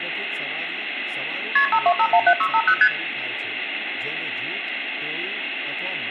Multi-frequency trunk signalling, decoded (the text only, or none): KP 52517650 ST